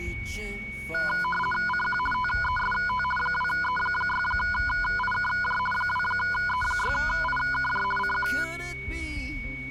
RTTY (50 baud, 450 Hz shift), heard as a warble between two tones, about 1230 Hz centre, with a steady whistle near 2230 Hz. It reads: CQ TEST 2E6IKJ 2E6IKJ CQ